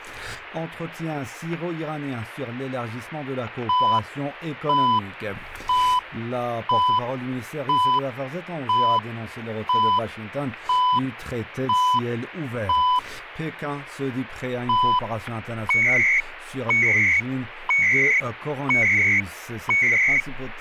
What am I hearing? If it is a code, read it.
Radio time signal (CHU, Canada), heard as beeps and data bursts, one a second.